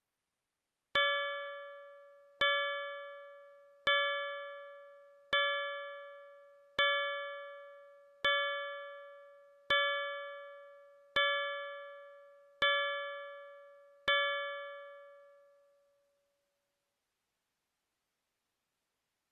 Clock strike, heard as a bell. 10. Ten o'clock.